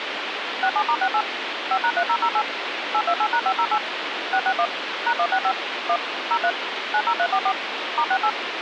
DTMF, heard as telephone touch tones, dialled by machine, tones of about 70 ms, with phone line noise. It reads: 67*68 5#3008 828#508 661 #165 1 03 90344 *68